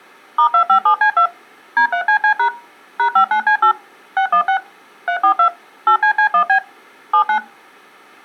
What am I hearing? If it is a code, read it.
DTMF, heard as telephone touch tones, dialled by machine, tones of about 90 ms. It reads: *257C2 D3CC# #59C8 616 342 8CC1B 79